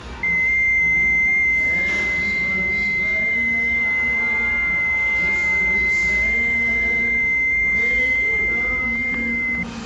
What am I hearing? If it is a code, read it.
FT8 (one signal), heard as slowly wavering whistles, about 6.25 baud, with static crashes and the noise of a restaurant.